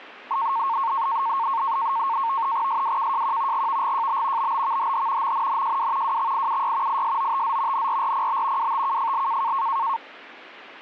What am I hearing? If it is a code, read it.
NAVTEX (SITOR-B), 100 baud, 170 Hz shift, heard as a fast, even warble, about 1000 Hz centre. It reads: SWKJQ GVGJB BBVHH MNNJW WXIUY ISOTZ NRRPB WTKFL